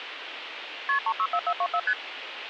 Multi-frequency trunk signalling (R1, as on North American trunks), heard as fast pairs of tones, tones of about 60 ms, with phone line noise. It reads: KP 364424 ST